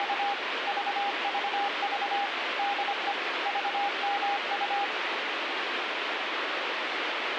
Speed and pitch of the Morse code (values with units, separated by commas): 25 wpm, 810 Hz